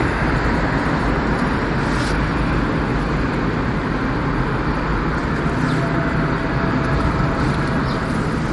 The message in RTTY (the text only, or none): none